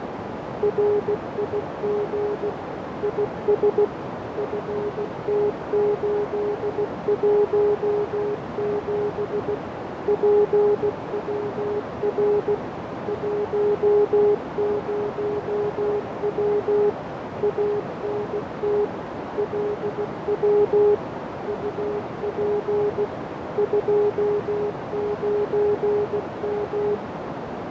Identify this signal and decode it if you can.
Morse code, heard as a keyed tone, machine-sent, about 16 wpm, 410 Hz, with heavy radio static, fading and a narrow filter. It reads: RIG IS FT817 PWR 10W ANT LW UP 29M